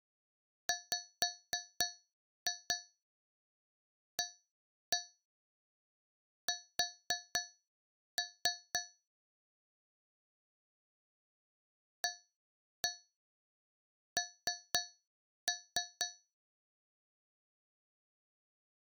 Tap code, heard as taps on a metal pipe, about 4 knocks a second. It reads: WAS AN